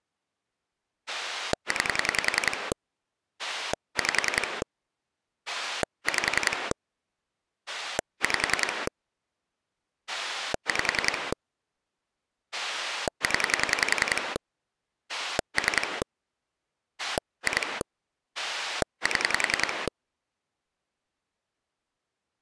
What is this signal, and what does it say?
Pulse dialling, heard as a rotary dial, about 10 pulses a second. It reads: 9 5 5 5 5 0 3 2 7